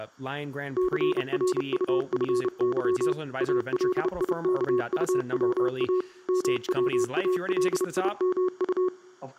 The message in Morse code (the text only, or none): CRUFY ALIKUWA MWALIMU